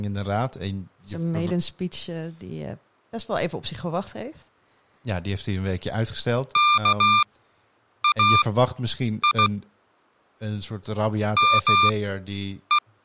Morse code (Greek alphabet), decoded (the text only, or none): ΚΑΙ ΜΕ